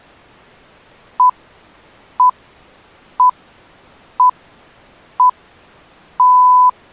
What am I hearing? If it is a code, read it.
Radio time signal (six pips, as the Greenwich Time Signal), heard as pips.